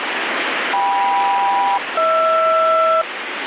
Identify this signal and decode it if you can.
Aircraft SELCAL, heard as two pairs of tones, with radio static. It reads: KM-HR